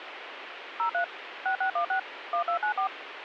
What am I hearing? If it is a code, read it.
DTMF, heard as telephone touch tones, dialled by machine, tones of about 100 ms, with radio hiss. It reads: 03 6616 1294